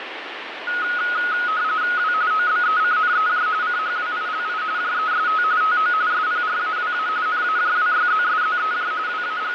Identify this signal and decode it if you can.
RTTY (45.45 baud, 170 Hz shift), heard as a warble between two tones, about 1360 Hz centre, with radio static. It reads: W OBECNEJ CHWILI JEST TO SPRAWA NAJWYZSZEJ …